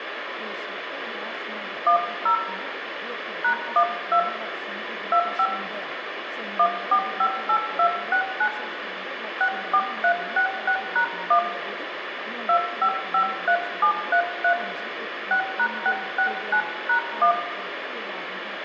DTMF, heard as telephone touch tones, dialled by hand, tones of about 80 ms, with phone line noise and room echo. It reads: 10 #12 25 1458269 64366#1 2553733 6#669#1